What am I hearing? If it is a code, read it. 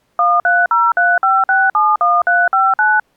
DTMF, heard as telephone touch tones, dialled by machine, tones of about 210 ms. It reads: 13035671359